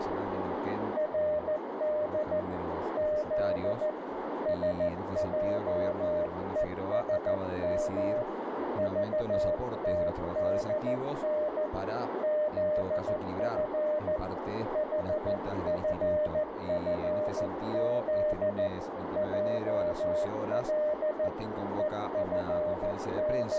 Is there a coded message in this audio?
Yes: Morse code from 0.9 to 23.6 s, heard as a keyed tone, hand-sent with a paddle, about 14 wpm, 610 Hz, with radio static and a narrow filter. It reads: RD Z SJESM VTDN ZF HFFZ JL …